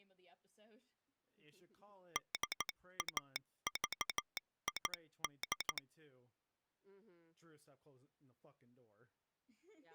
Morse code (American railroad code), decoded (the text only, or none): DAVID